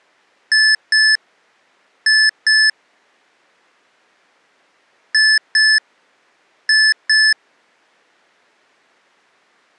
Beep code, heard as beeps from a small speaker, played twice, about 1750 Hz. 2-2.